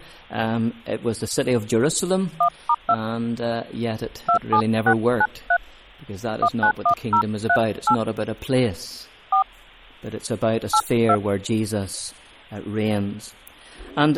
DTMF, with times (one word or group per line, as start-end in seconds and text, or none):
2.4-2.9 1*2
4.3-5.6 27693
6.4-7.9 191038
9.3-9.4 4
10.7-11.2 82